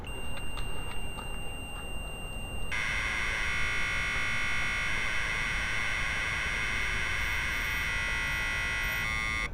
Commodore tape loading (standard loader), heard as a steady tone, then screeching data, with street noise.